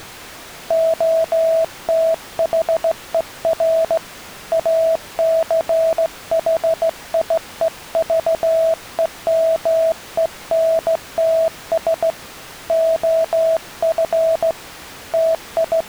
Morse code, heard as a keyed tone, hand-sent with a straight key, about 16 wpm, 650 Hz. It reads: OTHER ACHIEVEMENTS OF …